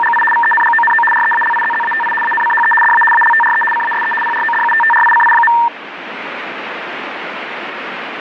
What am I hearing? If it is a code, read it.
RTTY (75 baud, 850 Hz shift), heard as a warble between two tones, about 1360 Hz centre, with radio static. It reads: … VENGONO REALIZZATI ANCHE DA ALTRE CASE PRODUTTRICI.